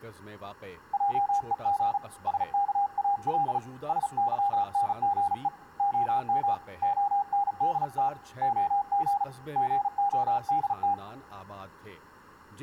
Morse code, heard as a keyed tone, hand-sent with a paddle, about 36 wpm, 810 Hz, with speech in Urdu. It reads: JEG SKAL SYNGE OM ONDT OG GODT